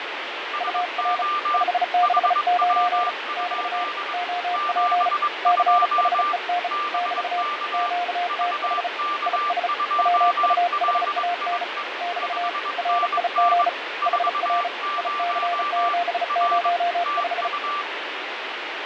Morse code, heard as two keyed tones, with heavy radio static and fading. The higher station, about 22 wpm, 1180 Hz: SO HW? 72 BK VK2LIE 5NN 40 R TU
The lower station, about 35 wpm, 710 Hz: UR 569 <BT> OP CHEN <BT> QTH IS WUHAN <BT> RIG HR IC705